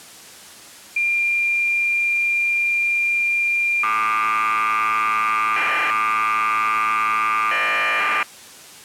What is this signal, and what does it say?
Cassette data (Kansas City type), 1200 baud, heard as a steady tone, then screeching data.